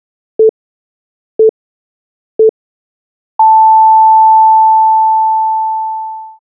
Radio time signal (three low pips and a long one an octave up, as on NHK), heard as pips.